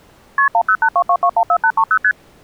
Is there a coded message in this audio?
Yes: multi-frequency trunk signalling (R1, as on North American trunks) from 0.4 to 2.1 s, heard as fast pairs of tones, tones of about 70 ms. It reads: KP 10822214830 ST